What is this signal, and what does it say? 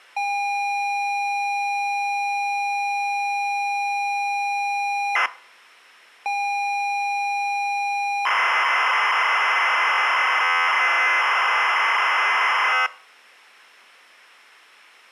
ZX Spectrum tape loading, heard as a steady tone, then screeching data.